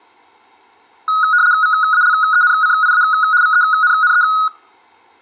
RTTY (75 baud, 170 Hz shift), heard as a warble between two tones, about 1360 Hz centre, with room echo. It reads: VALENCIA VENNE